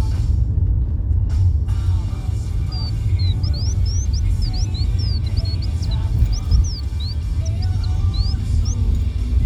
Bird-like chirps, with the noise inside a car. There is no code.